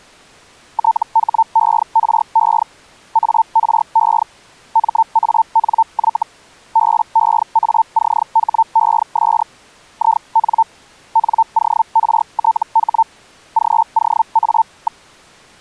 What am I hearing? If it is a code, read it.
Hellschreiber (Feld-Hell, 122.5 baud), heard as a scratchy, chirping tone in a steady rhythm, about 900 Hz. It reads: THERE ARE MANY BEACHES IN NORTH GOA.